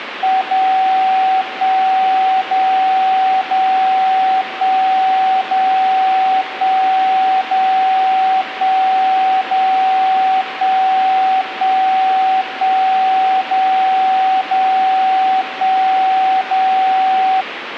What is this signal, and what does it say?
Radio time signal (DCF77), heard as a tone whose level steps once a second, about 760 Hz, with radio static. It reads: 0 1 0 0 1 0 1 0 1 0 1 1 1 0 0 1 0